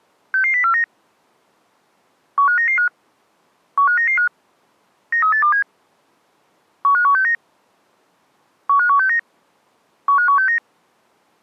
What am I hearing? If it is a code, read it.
Five-tone selective call (CCIR), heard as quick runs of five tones, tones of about 100 ms. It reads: 66049 15995 15995 93827 15169 15169 15169